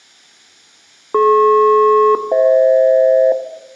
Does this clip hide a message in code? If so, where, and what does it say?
Yes: aircraft SELCAL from 1.1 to 3.3 s, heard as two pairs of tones, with room echo. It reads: DP-FH